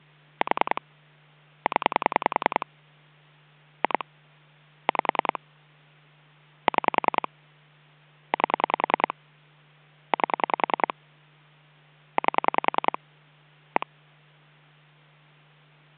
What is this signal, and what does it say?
Pulse dialling, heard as clicks on a phone line, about 10 pulses a second, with hum. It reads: 4 0 2 5 6 8 8 8 1